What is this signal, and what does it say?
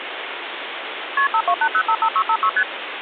Multi-frequency trunk signalling (R1, as on North American trunks), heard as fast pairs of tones, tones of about 70 ms, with phone line noise. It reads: KP 528055656 ST